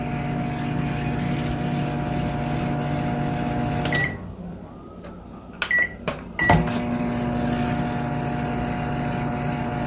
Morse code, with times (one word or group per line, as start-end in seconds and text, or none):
none